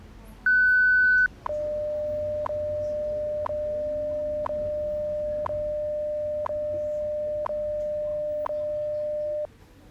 Radio time signal (WWV, Colorado), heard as ticks, one a second, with the noise inside a bus.